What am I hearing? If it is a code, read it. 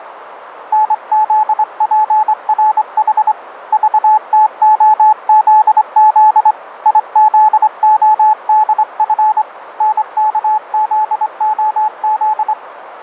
Morse code, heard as a keyed tone, hand-sent with a straight key, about 24 wpm, 860 Hz, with radio static and a narrow filter. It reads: NZPRH VTOZZ IZODF NKZOZ